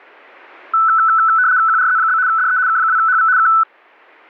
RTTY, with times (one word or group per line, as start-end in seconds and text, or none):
1.7-2.2 QRZ?
2.3-2.6 DE
2.7-3.3 K2HV
3.4-3.5 K